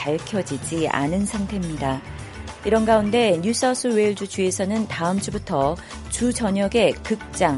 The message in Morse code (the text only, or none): none